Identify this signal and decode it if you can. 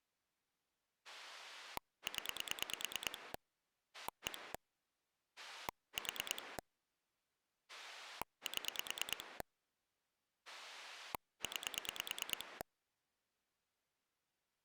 Pulse dialling, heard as a rotary dial, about 9 pulses a second. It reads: 0 1 4 7 9